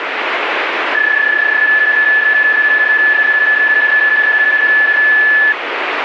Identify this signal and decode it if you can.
PSK31 (31.25 baud), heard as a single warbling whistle, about 1750 Hz, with radio static.